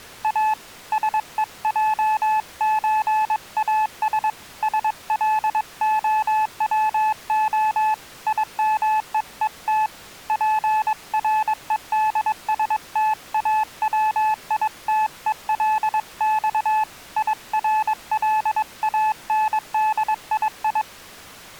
Morse code (Russian alphabet), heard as a keyed tone, hand-sent with a paddle, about 22 wpm, 860 Hz. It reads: А СЕЙЧАС СЛОВО ИМЕЕТ ПРЕДСТАВИТЕЛЬ ИРЛАНДИИ